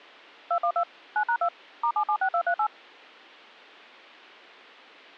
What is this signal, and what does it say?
DTMF, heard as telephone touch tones, dialled by machine, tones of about 80 ms. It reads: 212 9#2 *776238